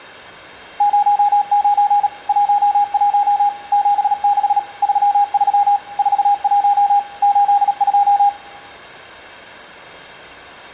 Morse code, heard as a keyed tone, machine-sent, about 37 wpm, 820 Hz, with room echo. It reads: 09 11 76 33 41 82